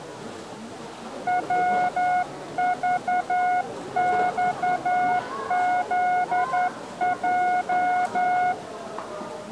Morse code, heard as a keyed tone, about 11 wpm, 720 Hz, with the noise of a crowd indoors. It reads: WVXZJ